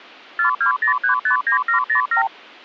Multi-frequency trunk signalling (R2, with the far end's replies), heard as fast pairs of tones, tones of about 110 ms. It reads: 420359707